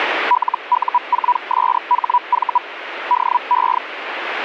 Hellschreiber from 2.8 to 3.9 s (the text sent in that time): DE